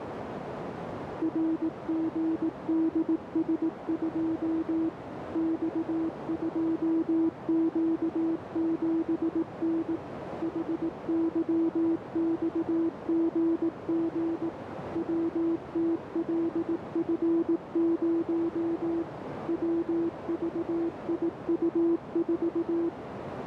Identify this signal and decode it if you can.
Morse code, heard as a keyed tone, machine-sent, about 18 wpm, 330 Hz, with radio static and a narrow filter. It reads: RGDS2 X2Q7N HYXGG WTLF0 WVIU4